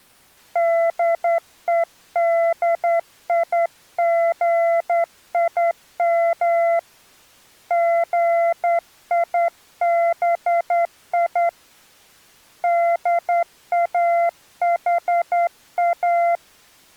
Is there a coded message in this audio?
Yes: Morse code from 0.5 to 16.4 s, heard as a keyed tone, hand-sent with a straight key, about 10 wpm, 680 Hz. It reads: DEDIGIM GIBI DAHA